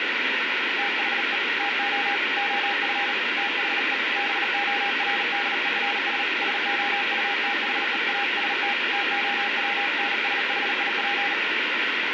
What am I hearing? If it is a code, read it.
Morse code, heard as a keyed tone, hand-sent with a paddle, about 38 wpm, 810 Hz, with heavy radio static. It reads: THE TO OF THE BORDERS SOUTHEAST TOWNSHIP